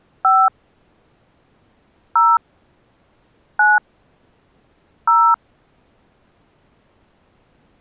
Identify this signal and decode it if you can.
DTMF, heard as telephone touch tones, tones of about 200 ms. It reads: 5 0 9 0